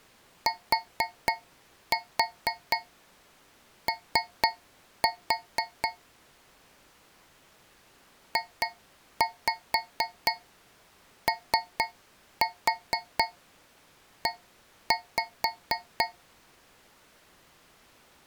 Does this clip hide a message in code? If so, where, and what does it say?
Yes: tap code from 0.5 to 16.3 s, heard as taps on a metal pipe, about 4 knocks a second. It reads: TO JOE